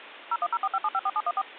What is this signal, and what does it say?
DTMF, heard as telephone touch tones, dialled by machine, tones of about 50 ms, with phone line noise. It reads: 01045754714